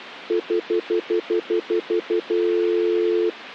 Telephone call progress tone (North American plan), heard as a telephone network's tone, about 350, 440 Hz, 0.1 s on and 0.1 s off. Stutter dial tone.